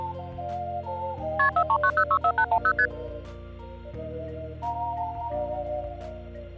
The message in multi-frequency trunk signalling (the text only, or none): KP 439064810 ST